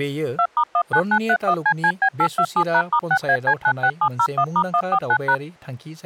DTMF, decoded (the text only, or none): 2*19931CCB827#*6AC96701*149#